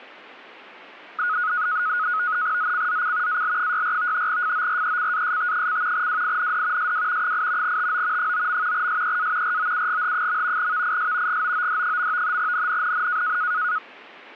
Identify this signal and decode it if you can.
NAVTEX (SITOR-B), 100 baud, 170 Hz shift, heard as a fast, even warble, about 1360 Hz centre. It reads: ZCZC AL64 FORECAST: WIND SW 8 TO 9. SEA ROUGH. VIS GOOD. NNNN